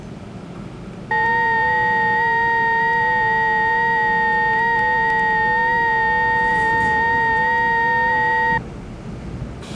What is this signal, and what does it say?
FT8 (several signals at once), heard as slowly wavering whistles, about 6.25 baud, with the noise inside a subway train.